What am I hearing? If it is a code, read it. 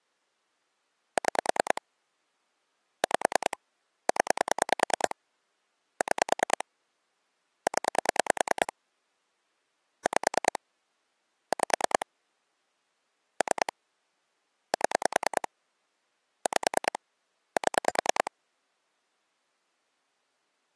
Pulse dialling, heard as clicks on a phone line, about 10 pulses a second. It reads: 6 5 0 6 0 5 5 3 7 5 7